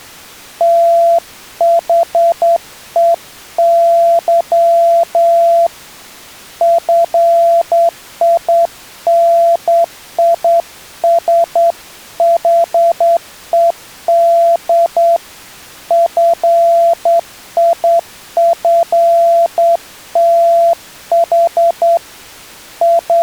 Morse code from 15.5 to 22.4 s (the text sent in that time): FIFTH